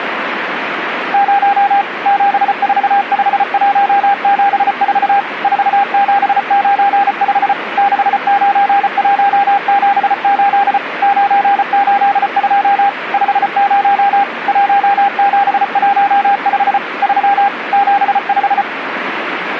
Morse code, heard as a keyed tone, machine-sent, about 34 wpm, 800 Hz, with radio static. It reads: 0 745174 4795 69178 982 50 1715 3 75